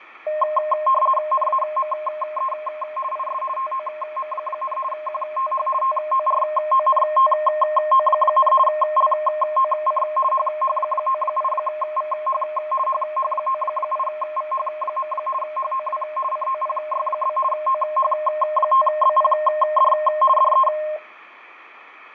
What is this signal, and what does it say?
RTTY (50 baud, 450 Hz shift), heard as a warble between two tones, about 840 Hz centre, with radio static, fading and room echo. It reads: NAME IS TOM, QTH TORONTO, LOC HH98VH HH98VH. HOW COPY? OH5BPD DE